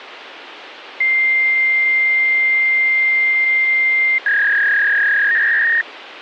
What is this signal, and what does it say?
Fax machine handshake, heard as a long tone and a warble, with phone line noise.